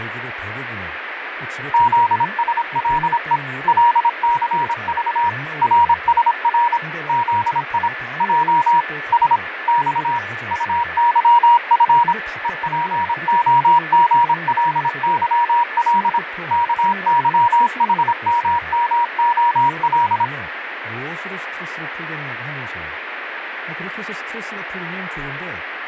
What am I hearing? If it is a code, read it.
Morse code, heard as a keyed tone, machine-sent, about 26 wpm, 950 Hz, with radio static, fading, a weaker station near 1740 Hz and speech in Korean. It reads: ZSLE LCV RSR ZI J S X UYF EPOGLYL KYHMMOL